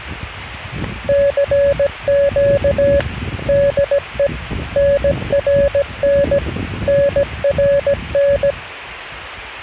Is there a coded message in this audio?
Yes: Morse code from 1.0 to 8.6 s, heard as a keyed tone, machine-sent, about 17 wpm, 560 Hz, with the noise of a residential street. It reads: CQ DE NRN NRN